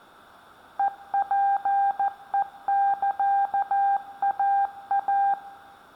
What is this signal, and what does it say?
Morse code (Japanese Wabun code), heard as a keyed tone, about 14 wpm, 800 Hz, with room echo. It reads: ヘツヘサイイ